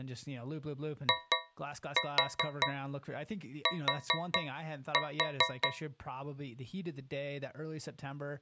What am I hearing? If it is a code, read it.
Tap code, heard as taps on a metal pipe, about 4 knocks a second, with speech in English. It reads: IT